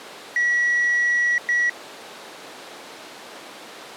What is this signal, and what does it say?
Beep code, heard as beeps, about 1950 Hz. 1 long, 1 short. In IBM BIOS tables: system board problem.